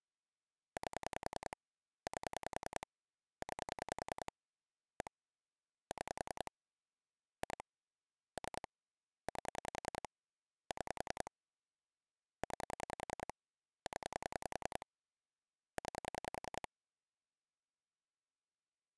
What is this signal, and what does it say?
Pulse dialling, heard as clicks on a phone line, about 10 pulses a second. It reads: 8 8 9 1 6 2 3 8 6 9 0 9